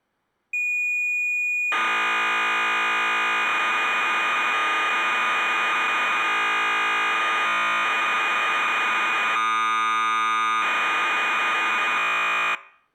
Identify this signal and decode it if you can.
Cassette data (Kansas City type), 1200 baud, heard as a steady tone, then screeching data.